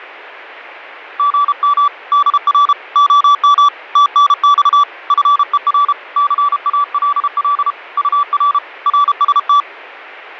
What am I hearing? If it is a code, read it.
Morse code, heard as a keyed tone, hand-sent with a paddle, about 32 wpm, 1160 Hz. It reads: GM DR OM TNX FER CALL UR RST